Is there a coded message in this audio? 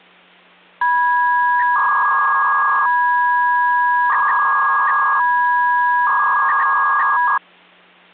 Yes: 300-baud modem data (V.21 tones) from 0.8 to 7.4 s, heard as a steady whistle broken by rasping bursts, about 300 baud, 200 Hz shift, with hum.